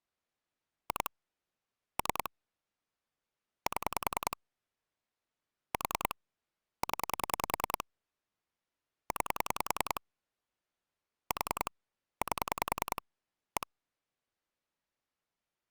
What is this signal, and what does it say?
Pulse dialling, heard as clicks on a phone line, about 10 pulses a second. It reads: 2 3 7 4 0 9 4 8 1